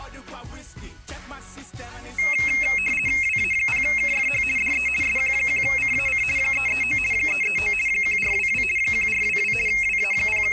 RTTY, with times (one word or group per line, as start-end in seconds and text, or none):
3.2-4.4 WA0KFH
4.6-4.9 DE
5.0-6.2 SQ1CAC
6.4-7.0 339
7.1-7.7 339
7.9-8.6 1422
8.8-9.5 1422
9.7-10.5 …